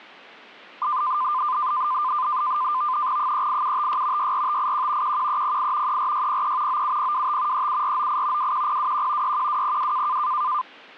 NAVTEX (SITOR-B), 100 baud, 170 Hz shift, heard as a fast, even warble, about 1110 Hz centre. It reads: 38756 64581 11308 34603 97025 37498 21021 61202